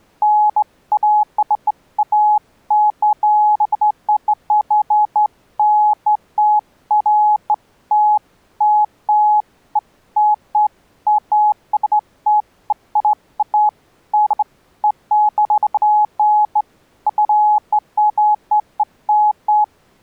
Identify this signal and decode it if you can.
Beeps of irregular length. There is no code.